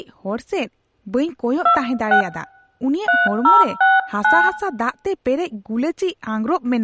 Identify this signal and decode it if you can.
DTMF, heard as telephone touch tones, dialled by hand, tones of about 170 ms, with room echo and speech in Santali. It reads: 26 3069